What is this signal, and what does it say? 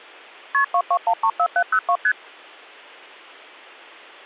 Multi-frequency trunk signalling (R1, as on North American trunks), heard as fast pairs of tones, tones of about 70 ms. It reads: KP 22134702 ST